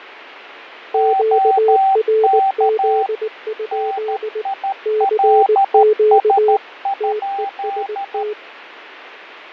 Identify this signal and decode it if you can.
Morse code, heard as two keyed tones, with radio static and fading. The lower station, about 19 wpm, 430 Hz: QRZ? CQ TEST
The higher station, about 13 wpm, 780 Hz: OK NILS?